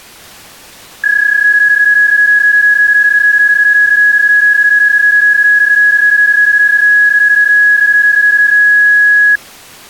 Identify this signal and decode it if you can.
PSK31 (31.25 baud), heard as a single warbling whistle, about 1650 Hz.